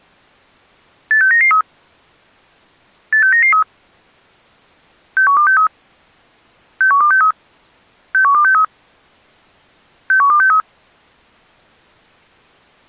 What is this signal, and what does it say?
Five-tone selective call (CCIR), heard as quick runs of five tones, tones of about 100 ms. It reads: 86993 86993 61263 61263 61263 61263